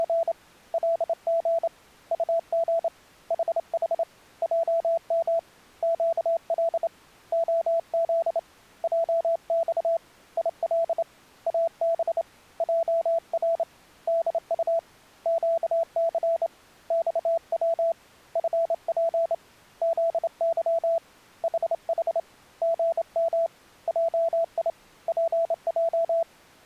Morse code, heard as a keyed tone, hand-sent with a straight key, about 28 wpm, 670 Hz. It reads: … LG UG HH JM QL OZ JX IL AB JR DU QC XW FP ZY HH GM JI PJ